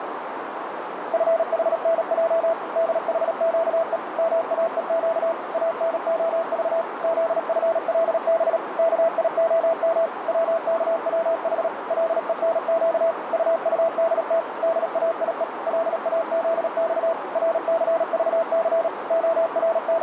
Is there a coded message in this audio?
Yes: Morse code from 1.1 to 20.0 s, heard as a keyed tone, machine-sent, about 37 wpm, 660 Hz, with radio static and a narrow filter. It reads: FHNJ DHQE MAEQ ANOV ZFLB KIOM WKWH LENQ UUDT DAIE LAZX RCVC …